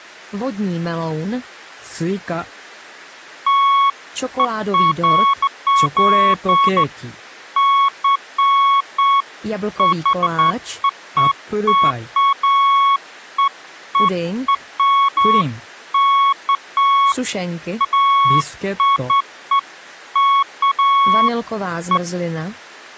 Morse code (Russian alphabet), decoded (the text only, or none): none